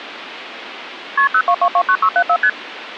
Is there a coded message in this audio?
Yes: multi-frequency trunk signalling (R1, as on North American trunks) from 1.2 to 2.5 s, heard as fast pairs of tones, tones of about 70 ms, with phone line noise. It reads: KP 02229674 ST